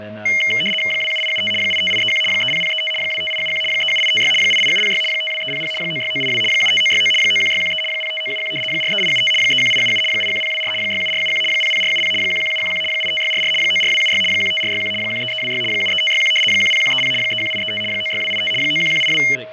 RTTY (75 baud, 850 Hz shift), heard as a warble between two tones, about 2550 Hz centre, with fading, static crashes, a steady whistle near 630 Hz and speech in English. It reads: 27875 85831 30035 25871 37856 88706 52300 96982 75969 91613 05971 43875 31877 81024 67471 00470 11711 85644 94276 15461 13326 73561 10130 31835 96285 91182